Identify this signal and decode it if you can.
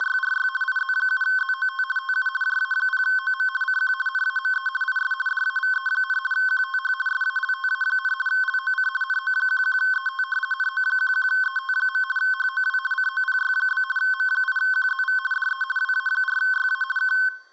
RTTY (50 baud, 450 Hz shift), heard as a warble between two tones, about 1290 Hz centre. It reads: … IZ7ZOT TU JA0OM CQ NAME IS DAVE, QTH SALTA, LOC NO11ET NO11ET. HOW COPY? M8QZV DE WA4YA K